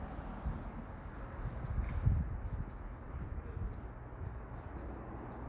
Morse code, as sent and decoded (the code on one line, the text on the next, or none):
none